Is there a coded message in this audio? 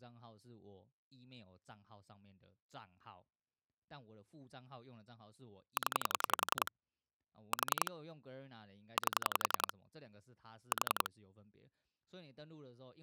Yes: pulse dialling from 5.8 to 11.1 s, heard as clicks on a phone line, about 11 pulses a second, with speech in Chinese. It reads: 0 4 8 4